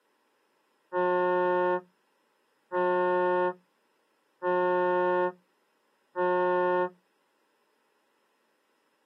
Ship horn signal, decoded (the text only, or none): 4 short